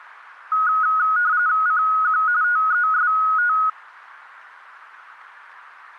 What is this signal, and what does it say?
RTTY (45.45 baud, 170 Hz shift), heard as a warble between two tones, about 1360 Hz centre. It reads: CQ TEST